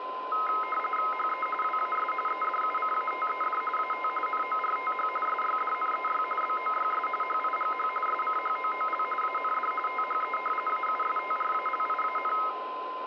RTTY (45.45 baud, 850 Hz shift), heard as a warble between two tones, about 1700 Hz centre, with radio static, a steady whistle near 1030 Hz and room echo. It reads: HE WAS EDUCATED AT NORTH SYDNEY BOYS HIGH SCHOOL AND THE AUSTRALIAN